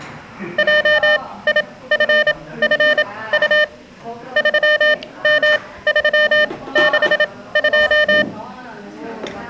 Morse code, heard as a keyed tone, machine-sent, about 27 wpm, spaced as for 18 wpm, 600 Hz, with room echo and the noise of a crowd indoors. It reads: JIFFU 3M362